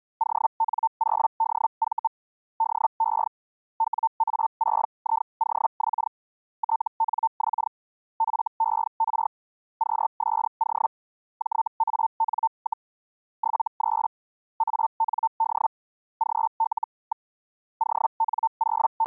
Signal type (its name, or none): Hellschreiber